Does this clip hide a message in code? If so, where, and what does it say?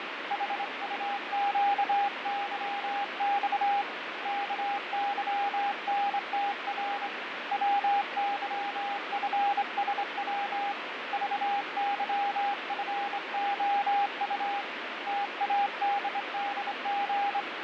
Yes: Morse code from 0.2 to 17.5 s, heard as a keyed tone, hand-sent with a straight key, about 25 wpm, 810 Hz, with radio static and fading. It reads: HUQYX KYNTR WYFSW VYFOU TADDG